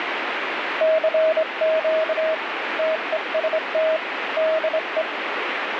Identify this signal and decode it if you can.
Morse code, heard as a keyed tone, hand-sent with a straight key, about 24 wpm, 640 Hz, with radio static. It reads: CQ TEST DE